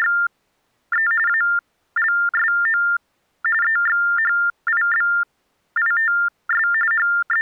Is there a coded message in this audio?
Yes: TTY/TDD text telephone tones (45.45 baud Baudot) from 0.0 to 7.4 s, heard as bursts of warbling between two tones, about 400 Hz shift, 1600 Hz centre. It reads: … ALSO EXHIBITS …